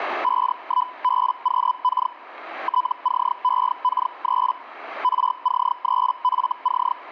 Hellschreiber (Feld-Hell, 122.5 baud), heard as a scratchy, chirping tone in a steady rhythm, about 1000 Hz. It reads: 51BQK TCEK3 RC3FC